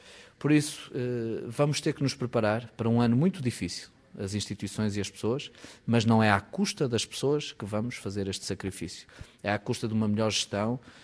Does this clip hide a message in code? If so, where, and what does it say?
No.